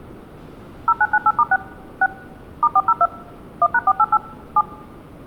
DTMF, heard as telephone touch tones, dialled by machine, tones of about 50 ms. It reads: 0998*6 6 *402 1#488 7